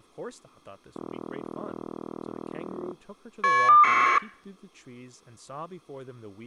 Caller ID data burst, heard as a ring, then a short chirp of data, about 1200 baud, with speech in English.